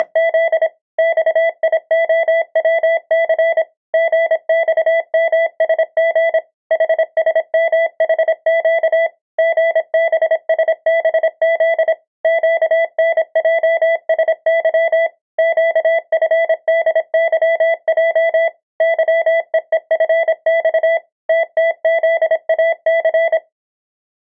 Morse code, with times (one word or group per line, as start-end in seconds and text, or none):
0.0-0.7 …
1.0-3.6 XIOWC
3.9-6.4 GXMSG
6.7-9.1 HSMHQ
9.4-11.9 GBSBZ
12.2-15.1 QNJSY
15.4-18.5 QFDYJ
18.8-21.0 YEEFX
21.3-23.4 TTZAC